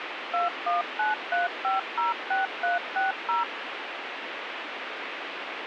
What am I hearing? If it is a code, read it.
DTMF, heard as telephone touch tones, dialled by machine, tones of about 150 ms, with radio hiss. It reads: 2193506360